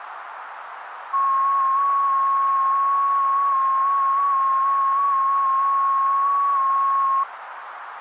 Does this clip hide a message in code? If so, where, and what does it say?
Yes: FT8 (one signal) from 1.1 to 7.2 s, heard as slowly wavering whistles, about 6.25 baud, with radio static and a narrow filter.